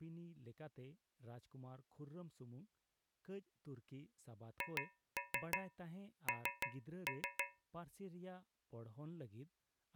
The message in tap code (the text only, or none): HN